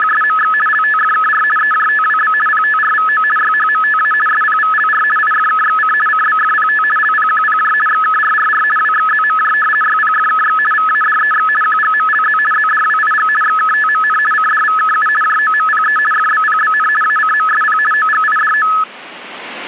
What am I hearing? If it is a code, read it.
RTTY (50 baud, 450 Hz shift), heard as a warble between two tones, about 1500 Hz centre. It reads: … LTFKR EJTWB PTRVO YHMTA SPVLR IFKXC CBFPT LPQPJ XKRRR WXZMJ YPFKX VADEX QGMLZ ZDWIG XKTMN CDVKU JOMPE FBPBN ACMSP OGIDO